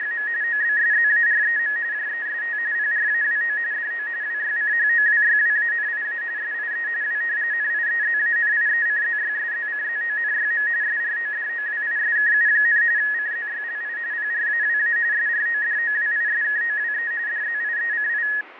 RTTY (45.45 baud, 170 Hz shift), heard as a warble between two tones, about 1800 Hz centre, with radio static and fading. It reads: … OBSZAREM JEST PRAWO DO WYCHOWYWANIA SIE W NIEZANIECZYSZCZONYM SRODOWISKU, CZYLI PRAWA SRODOWISKOWE DZIECI